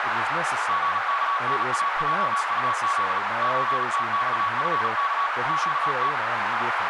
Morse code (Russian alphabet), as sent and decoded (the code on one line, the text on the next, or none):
--. -.- -. .- .--- ..- --.. / ---. - -..- ..-. -.- / --.- -
ГКНАЙУЗ ЧТЬФК ЩТ